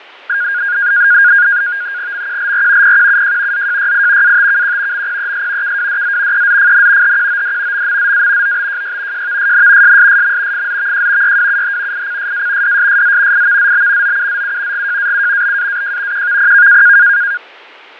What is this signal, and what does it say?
NAVTEX (SITOR-B), 100 baud, 170 Hz shift, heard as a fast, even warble, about 1550 Hz centre, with fading. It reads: MQLR PQUJ ZJYI ATKQ MPES KWDZ EZFN HQOD MMZA OBJY JVSN SSSM FZVJ YWUH ICSA DSSZ IVZB OUZU GJAU BAAJ QVPK